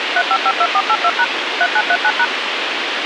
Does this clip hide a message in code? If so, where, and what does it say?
Yes: DTMF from 0.2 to 2.2 s, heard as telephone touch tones, dialled by machine, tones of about 60 ms, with radio hiss. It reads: 3552482# 3939#